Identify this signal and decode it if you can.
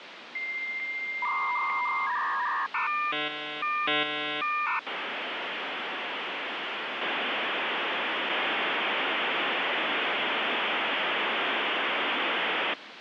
Dial-up modem handshake (V.34 or later), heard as a whistle, warbles, then hiss, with phone line noise.